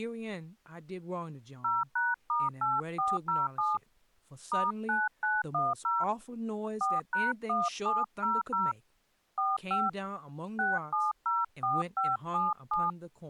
DTMF, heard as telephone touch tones, dialled by hand, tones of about 190 ms, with speech in English. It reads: 0#*8407 *9910 4#1700 45 6704577